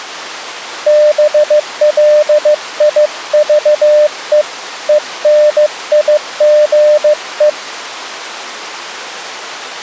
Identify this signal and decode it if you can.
Morse code, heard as a keyed tone, hand-sent with a paddle, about 15 wpm, 600 Hz. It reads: BLIVE ENIGE